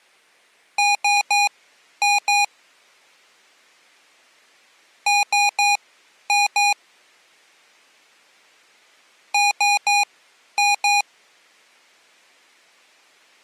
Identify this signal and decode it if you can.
Beep code, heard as beeps from a small speaker, played three times, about 820 Hz. 3-2.